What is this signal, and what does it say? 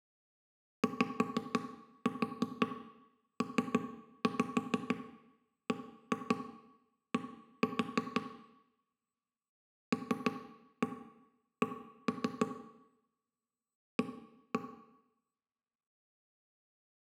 Tap code, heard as knocks on wood, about 6 knocks a second, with room echo. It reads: YPBD LC A